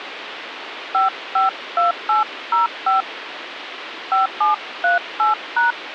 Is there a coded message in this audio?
Yes: DTMF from 0.9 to 5.7 s, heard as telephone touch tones, dialled by hand, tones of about 140 ms, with phone line noise. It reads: 552805 5738#